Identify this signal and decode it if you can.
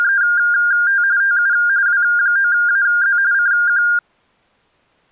RTTY (45.45 baud, 170 Hz shift), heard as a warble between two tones, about 1500 Hz centre. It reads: … TU W9AZ CQ